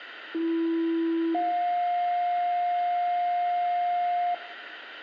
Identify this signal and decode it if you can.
Two-tone page, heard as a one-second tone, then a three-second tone, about 330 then 710 Hz, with radio hiss and room echo.